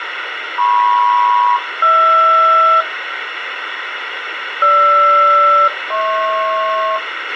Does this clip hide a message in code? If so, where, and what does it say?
Yes: aircraft SELCAL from 0.6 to 7.0 s, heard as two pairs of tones, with radio hiss and a squelch burst at the end. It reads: MP-HR GR-HP